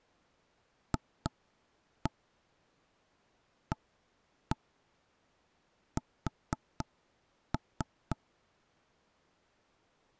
Tap code, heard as knocks on wood, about 3 knocks a second. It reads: FAS